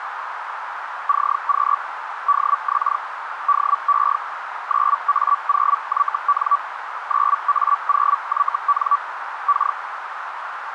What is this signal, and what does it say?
Hellschreiber (Feld-Hell, 122.5 baud), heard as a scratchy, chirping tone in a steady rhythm, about 1150 Hz, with radio static and a narrow filter. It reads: CQ DX DE 9A0YN 9A0YN K